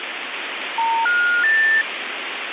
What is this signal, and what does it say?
Telephone call progress tone (North American plan), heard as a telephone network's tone, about 910, 1430, 1800 Hz, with phone line noise. Special information tone.